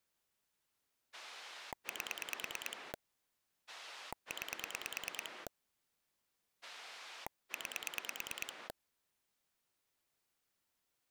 Pulse dialling, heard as a rotary dial, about 9 pulses a second. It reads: 8 9 9